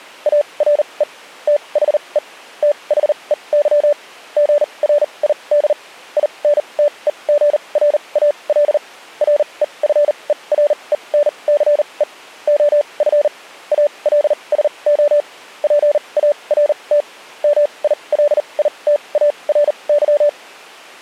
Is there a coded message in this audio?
Yes: Morse code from 0.2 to 20.4 s, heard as a keyed tone, machine-sent, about 39 wpm, spaced as for 28 wpm, 580 Hz. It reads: ARE THE THEY GRID INTEGRAL REFERENCE OF ALSO PART MILITARY